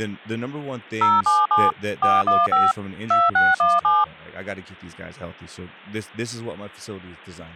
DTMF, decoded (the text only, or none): 077 415 2617